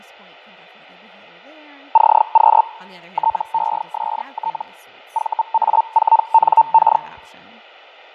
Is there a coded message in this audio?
Yes: Hellschreiber (Feld-Hell, 122.5 baud) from 1.9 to 7.0 s, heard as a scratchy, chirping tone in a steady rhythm, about 900 Hz, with fading and speech in English. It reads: CQ TEST VA4NK